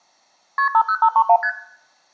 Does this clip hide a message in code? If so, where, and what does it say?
Yes: multi-frequency trunk signalling (R1, as on North American trunks) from 0.6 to 1.5 s, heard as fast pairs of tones, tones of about 70 ms, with room echo. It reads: KP 50531 ST